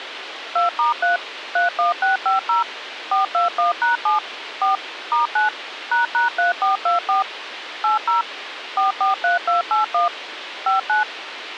DTMF, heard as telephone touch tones, dialled by machine, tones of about 140 ms, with radio hiss. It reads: 2*3 31650 421#7 4 *9 ##3424 80 443281 59